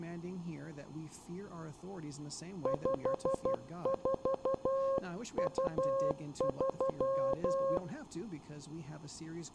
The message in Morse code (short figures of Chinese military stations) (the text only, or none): 5423